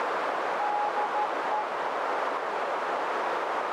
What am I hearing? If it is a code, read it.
Morse code, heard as a keyed tone, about 13 wpm, 840 Hz, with heavy radio static and a narrow filter. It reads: DE